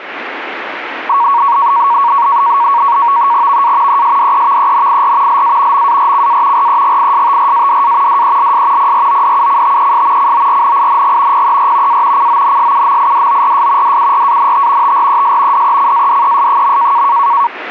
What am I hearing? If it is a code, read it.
NAVTEX (SITOR-B), 100 baud, 170 Hz shift, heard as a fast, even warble, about 1030 Hz centre. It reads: VA ESDEVENIR LA MARCA REGISTRADA DELS PRODUCTES CORNING PER A CONSUMIDORS DURANT TRES DECADES.